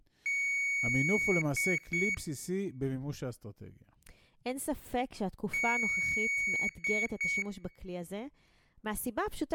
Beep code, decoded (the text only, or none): 1 long, 2 short